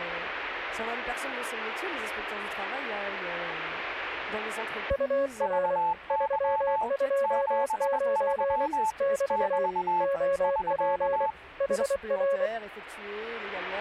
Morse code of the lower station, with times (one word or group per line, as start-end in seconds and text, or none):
4.9-5.8 UR
6.1-8.7 329
9.0-9.7 <BT>
10.0-11.3 OP
11.6-12.5 HR